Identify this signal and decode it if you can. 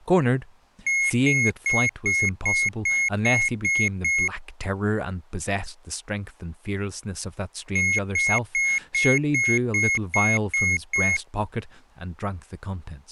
Beep code, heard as a piezo beeper, played twice, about 2150 Hz, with speech in English. 9 short. In AMI BIOS tables: ROM checksum failure.